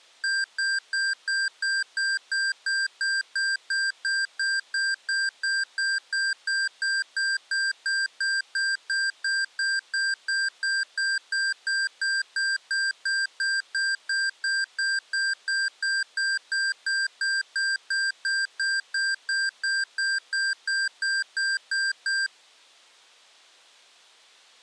Evenly repeated beeps. There is no code.